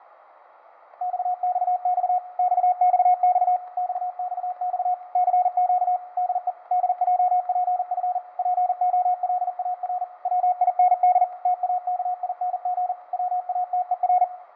Morse code, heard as a keyed tone, machine-sent, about 40 wpm, 720 Hz, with radio static, fading and room echo. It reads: XXX XXX XXX CQ DE DJPF POLAR WIND TAKING WATER